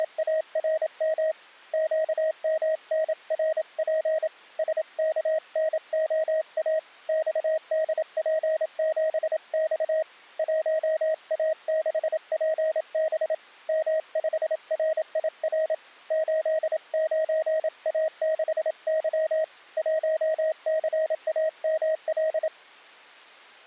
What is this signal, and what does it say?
Morse code, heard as a keyed tone, hand-sent with a paddle, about 27 wpm, 630 Hz. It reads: … QMNRP SKNOA XDP7X 1A6PB M5RIR 89A6Y 1CAML